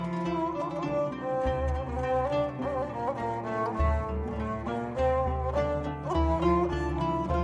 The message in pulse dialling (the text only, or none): none